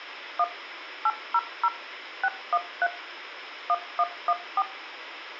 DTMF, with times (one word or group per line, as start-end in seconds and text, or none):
0.4-0.4 1
1.1-1.7 800
2.2-2.9 613
3.7-4.6 1114